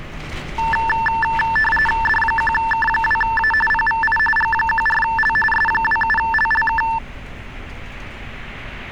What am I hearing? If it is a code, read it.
RTTY (45.45 baud, 850 Hz shift), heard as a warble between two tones, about 1330 Hz centre, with street noise. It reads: D1K2A PVI G14L S27LLK